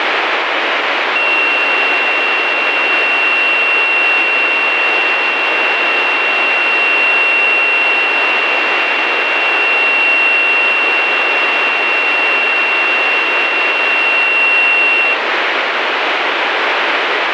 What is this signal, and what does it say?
A steady tone, with heavy radio static. There is no code.